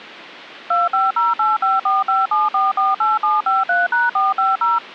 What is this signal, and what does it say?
DTMF, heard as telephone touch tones, dialled by machine, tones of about 180 ms. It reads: 25085457448753#450